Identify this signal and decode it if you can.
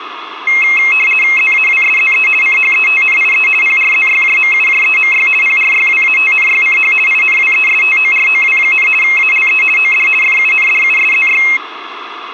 RTTY (50 baud, 450 Hz shift), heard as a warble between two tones, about 2350 Hz centre, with radio static and room echo. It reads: ZAWSZE CHETNIE PRZYJMUJEMY PRYWATNYCH INWESTOROW, ALE OD FUNDUSZY